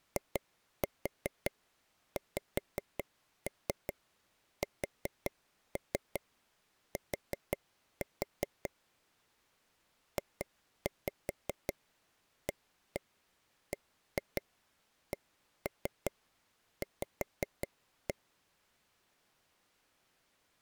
Tap code, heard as taps on a table, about 5 knocks a second. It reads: IXST JABCV